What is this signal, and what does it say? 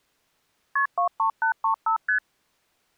Multi-frequency trunk signalling (R1, as on North American trunks), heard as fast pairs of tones, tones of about 100 ms. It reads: KP 23835 ST